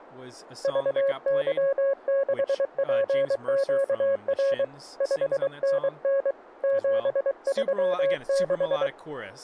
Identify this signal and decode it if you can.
Morse code, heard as a keyed tone, hand-sent with a paddle, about 23 wpm, 550 Hz, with speech in English. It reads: VY6PQR 5NN 736